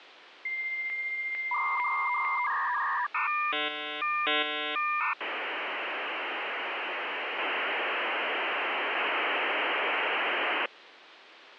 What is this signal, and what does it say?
Dial-up modem handshake (V.34 or later), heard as a whistle, warbles, then hiss, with phone line noise.